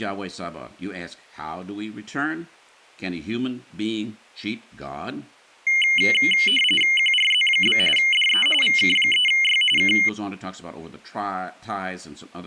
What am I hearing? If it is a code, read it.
RTTY (45.45 baud, 850 Hz shift), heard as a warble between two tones, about 2550 Hz centre, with speech in English. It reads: QRZ? DE VK3Y K